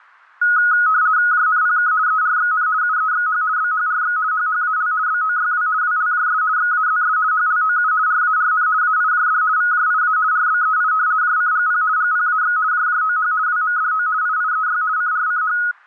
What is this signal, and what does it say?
RTTY (50 baud, 170 Hz shift), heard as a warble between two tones, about 1360 Hz centre. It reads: JNPK ERXN UEXH BHRX HHAL BOYW WLJS XAZS HLOU RARN AIJD VJIA RBEI JCGP GPAX JJOH WMDO IIEY CRCH